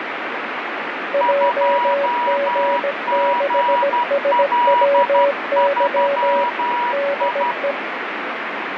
Morse code, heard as two keyed tones, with heavy radio static. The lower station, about 17 wpm, 560 Hz: JG6SWY DE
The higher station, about 12 wpm, 970 Hz: 2GL3I